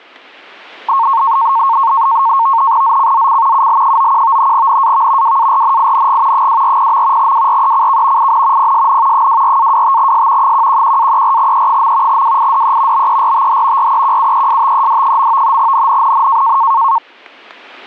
NAVTEX (SITOR-B), 100 baud, 170 Hz shift, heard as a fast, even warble, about 1000 Hz centre, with static crashes. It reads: ZCZC UL91 NAV WARNING 240. WRECK IN PSN 24-25S 111-34E. WIDE BERTH REQUESTED. NNNN